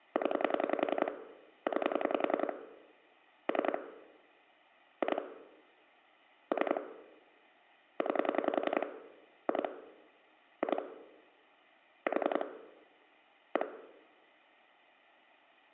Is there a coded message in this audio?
Yes: pulse dialling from 0.2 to 13.6 s, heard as clicks on a phone line, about 10 pulses a second, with room echo. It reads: 0 9 3 2 3 9 2 2 4 1